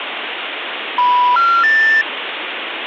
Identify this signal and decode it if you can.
Telephone call progress tone (North American plan), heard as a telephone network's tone, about 980, 1370, 1800 Hz, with phone line noise. Special information tone.